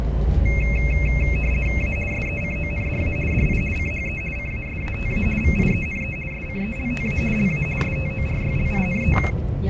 RTTY (50 baud, 450 Hz shift), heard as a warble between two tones, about 2350 Hz centre, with radio static and the noise inside a bus. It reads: A SECONDA DI CHE CASATA VIENE SCELTA LA STORYLINE